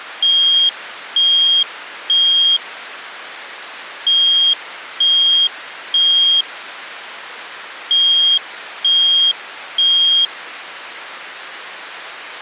Alarm pattern, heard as an alarm's beeps, played three times, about 3250 Hz. Temporal three. Smoke or fire, evacuate.